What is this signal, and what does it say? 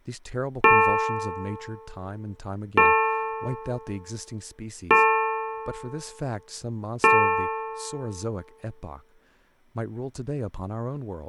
Clock strike, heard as a bell, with speech in English. 4. Four o'clock.